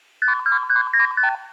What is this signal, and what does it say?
Multi-frequency trunk signalling (R2, with the far end's replies), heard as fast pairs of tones, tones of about 120 ms, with room echo. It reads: 52395